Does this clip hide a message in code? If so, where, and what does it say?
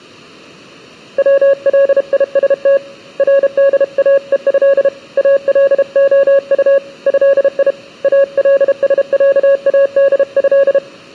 Yes: Morse code (Arabic alphabet) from 1.1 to 10.8 s, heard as a keyed tone, hand-sent with a paddle, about 32 wpm, 550 Hz. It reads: وليست رداءه الخط هي السعاده